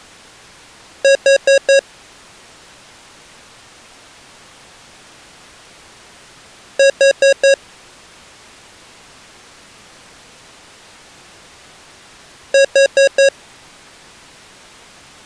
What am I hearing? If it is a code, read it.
Alarm pattern, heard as an alarm's beeps, played three times, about 550 Hz. Temporal four. Carbon monoxide.